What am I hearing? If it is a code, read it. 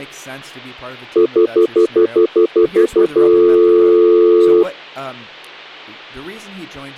Telephone call progress tone (North American plan), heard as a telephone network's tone, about 350, 440 Hz, 0.1 s on and 0.1 s off, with hum and speech in English. Stutter dial tone.